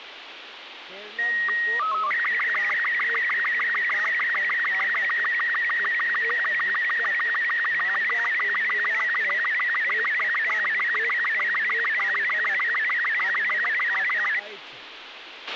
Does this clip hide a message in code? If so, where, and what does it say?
Yes: SSTV (slow-scan television), Robot 36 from 1.2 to 14.4 s, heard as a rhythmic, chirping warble, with radio hiss, a squelch burst at the end and speech in Maithili.